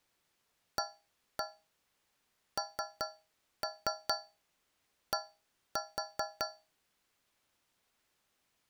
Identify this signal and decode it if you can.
Tap code, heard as taps on a metal pipe, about 5 knocks a second. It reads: AND